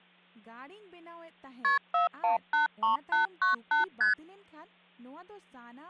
Multi-frequency trunk signalling (R1, as on North American trunks), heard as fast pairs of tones, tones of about 130 ms, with speech in Santali. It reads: KP 4183898 ST